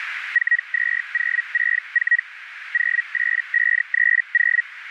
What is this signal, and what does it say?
Hellschreiber (Feld-Hell, 122.5 baud), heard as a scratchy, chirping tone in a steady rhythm, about 1900 Hz, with radio static and a narrow filter. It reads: 42064 08530